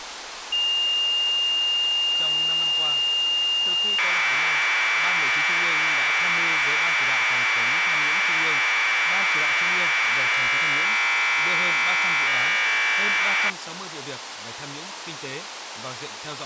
Commodore tape loading (standard loader), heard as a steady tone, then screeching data, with tape hiss and speech in Vietnamese.